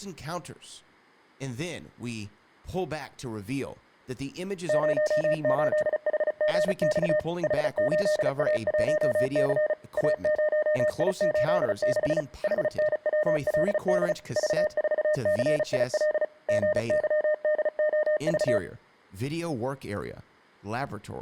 Morse code, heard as a keyed tone, machine-sent, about 35 wpm, 610 Hz, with speech in English. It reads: 08HGX H8A1C A0I86 HNWLD V4CIL GYDOV